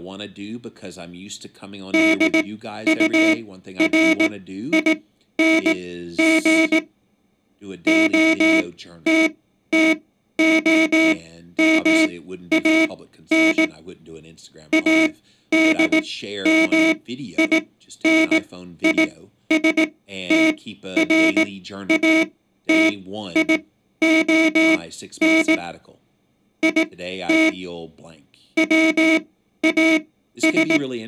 Morse code, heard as a buzzer, machine-sent, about 18 wpm, spaced as for 12 wpm, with speech in English. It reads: DURING OTTOMAN ADMINISTRATION IT WAS